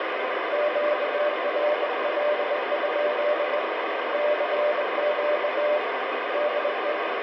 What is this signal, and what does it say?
Morse code, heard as two keyed tones, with heavy radio static. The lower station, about 21 wpm, 600 Hz: QRL? CQ DE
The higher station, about 31 wpm, 930 Hz: UTEWL E0LYG